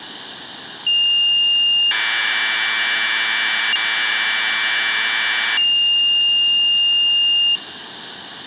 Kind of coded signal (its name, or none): Commodore tape loading